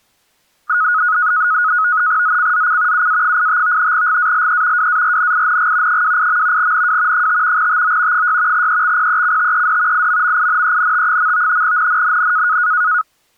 NAVTEX (SITOR-B), 100 baud, 170 Hz shift, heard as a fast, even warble, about 1360 Hz centre. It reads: ZCZC UA85 GALE WARNING 28. NW 5 TO 6 EXPECTED IMMINENT. NNNN